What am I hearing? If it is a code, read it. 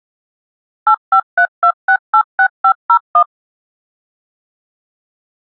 DTMF, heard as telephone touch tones, dialled by machine, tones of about 80 ms. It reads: 8532686501